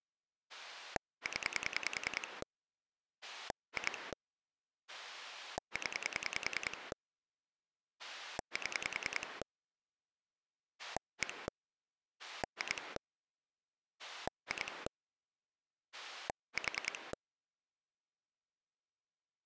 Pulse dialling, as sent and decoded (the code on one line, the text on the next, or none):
10 / 2 / 10 / 7 / 1 / 2 / 2 / 4
0 2 0 7 1 2 2 4